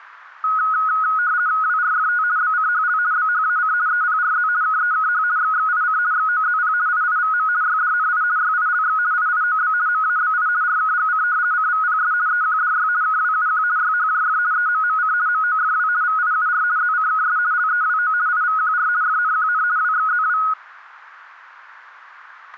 RTTY (50 baud, 170 Hz shift), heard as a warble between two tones, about 1360 Hz centre. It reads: WRFT BCHL BHAC EPRZ KEKH XXIC XOZP IIVM YDNI YILX IIOB MABI RKGC CVPS EQDY KWUQ YHJF EMMC MOFW VIUR ZCKS LEWO IVQR FNQN WXZW